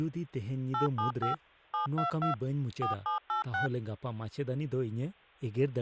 DTMF, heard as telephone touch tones, dialled by machine, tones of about 120 ms, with speech in Santali. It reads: 875 722 4786